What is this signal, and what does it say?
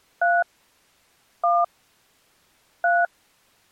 DTMF, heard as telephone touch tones, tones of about 210 ms. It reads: 3 1 3